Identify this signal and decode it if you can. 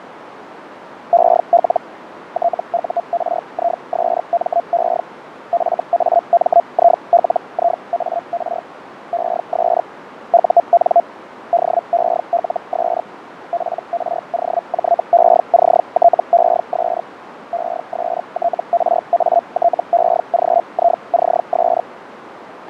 Hellschreiber (Feld-Hell, 122.5 baud), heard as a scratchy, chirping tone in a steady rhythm, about 690 Hz, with radio static, fading and a narrow filter. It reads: EL TURISME FAMILIAR ES UN DELS PROJECTES ESTRATEGICS